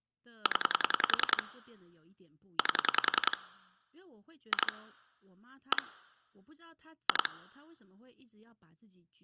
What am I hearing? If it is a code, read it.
Pulse dialling, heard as clicks on a phone line, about 10 pulses a second, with speech in Chinese. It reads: 0 8 2 1 2